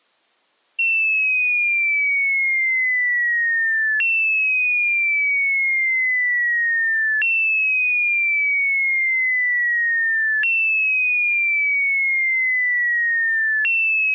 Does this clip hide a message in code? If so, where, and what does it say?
No, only a tone that sweeps in pitch again and again.